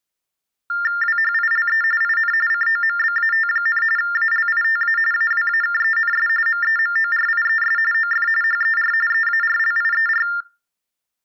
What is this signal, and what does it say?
TTY/TDD text telephone tones (45.45 baud Baudot), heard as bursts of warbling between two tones, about 400 Hz shift, 1600 Hz centre. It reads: WHILE IN COMBAT, ALITA AWAKENS MEMORIES OF HER EARLIER